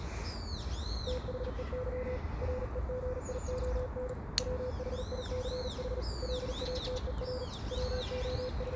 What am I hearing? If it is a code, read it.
Morse code, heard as a keyed tone, hand-sent with a paddle, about 39 wpm, 500 Hz, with the noise of a park. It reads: THEY REGION WHICH LATER …